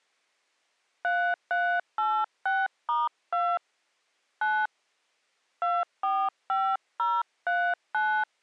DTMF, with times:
1.0-3.6 3386*2
4.4-4.7 9
5.6-8.2 245039

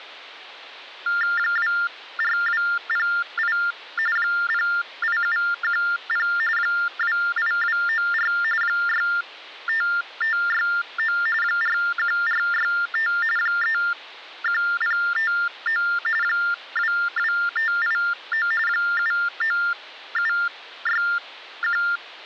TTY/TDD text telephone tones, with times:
1.4-3.6 24208
4.2-6.3 08710
6.6-8.3 28294
8.6-11.2 65569
11.4-13.1 41465
13.4-15.8 31059
16.2-18.5 22589
18.7-21.8 79761

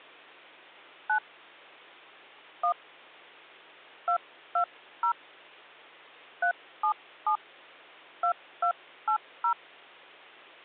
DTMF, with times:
1.1-1.2 9
2.6-2.7 1
4.1-5.1 220
6.4-7.4 377
8.2-9.5 2280

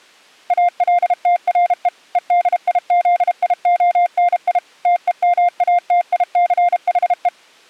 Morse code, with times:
0.5-1.9 ALTRE
2.2-4.6 EDIZIONI
4.9-7.3 TEMATICHE

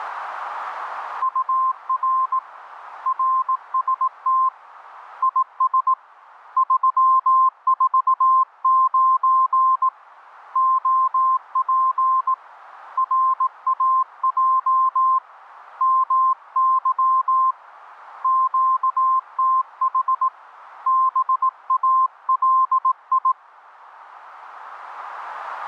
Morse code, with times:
1.2-2.4 UR
3.1-4.5 RST
5.2-5.9 IS
6.6-9.9 349
10.6-12.3 OP
13.0-15.2 RAJ
15.8-17.5 MY
18.2-20.3 QTH
20.9-23.3 BALI

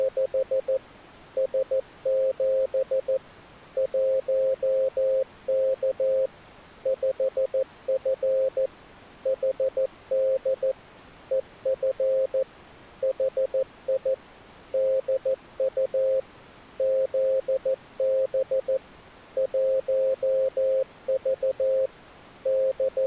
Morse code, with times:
0.0-0.8 …
1.4-3.2 S7
3.8-6.3 1K
6.9-8.7 5F
9.3-10.7 HD
11.3-12.4 EF
13.0-14.1 HI
14.7-16.2 DU
16.8-18.8 ZB
19.4-21.9 1V
22.5-23.1 …

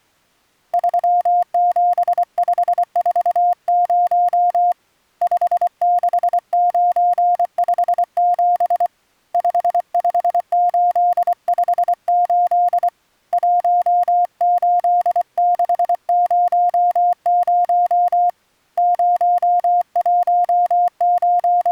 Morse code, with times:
0.7-4.7 37540
5.2-8.9 56957
9.3-12.9 55858
13.3-18.3 18600
18.8-21.7 …

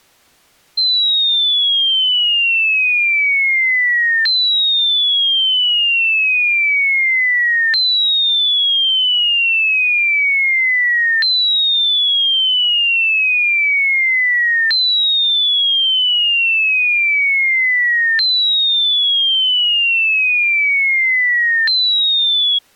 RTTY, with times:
none

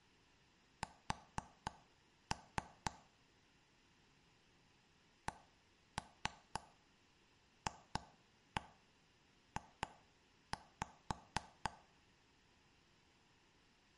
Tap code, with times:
0.8-2.9 S
5.3-11.7 CFJ

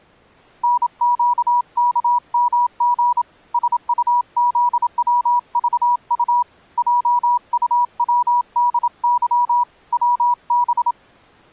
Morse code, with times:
0.6-3.2 NQKMG
3.5-6.4 SUZWVU
6.8-9.6 JUWDY
9.9-10.9 WB

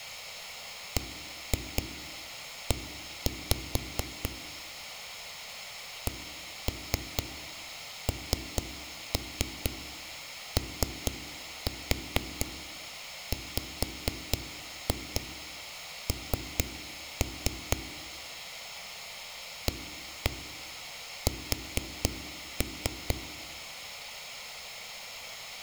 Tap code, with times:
1.0-4.3 BE
6.1-17.8 KNOWN
19.7-23.2 AS

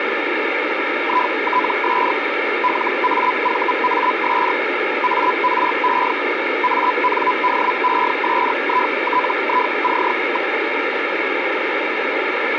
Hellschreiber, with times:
1.0-2.1 ITS
2.6-4.5 LAVAS
5.0-6.1 ARE
6.6-10.5 ANDESITIC.

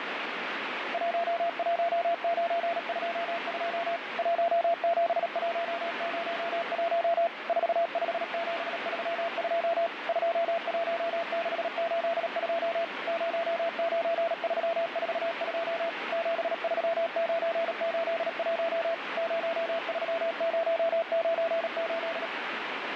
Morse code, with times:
0.9-4.0 11922
4.2-7.3 17101
7.5-9.9 45732
10.1-12.8 21682
13.1-15.9 09342
16.1-18.9 73981
19.2-22.3 03098

